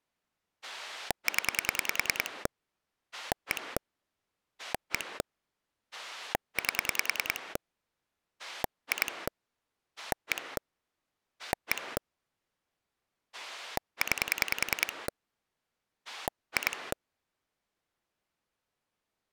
Pulse dialling, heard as a rotary dial, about 10 pulses a second. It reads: 0 1 1 8 2 1 1 9 2